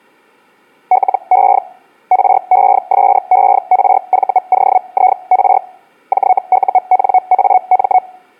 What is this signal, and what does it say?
Hellschreiber (Feld-Hell, 122.5 baud), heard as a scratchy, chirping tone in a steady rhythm, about 740 Hz. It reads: LE RESERVOIR JUNAM